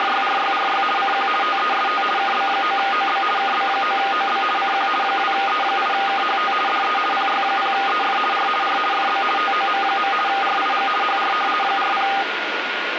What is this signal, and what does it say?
RTTY (50 baud, 450 Hz shift), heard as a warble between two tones, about 1010 Hz centre, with radio static and a steady whistle near 1430 Hz. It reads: … CQ TEST KB9OB KB9OB CQ 2E8KHT DE PY0EF R R FB TOM. RIG HR 40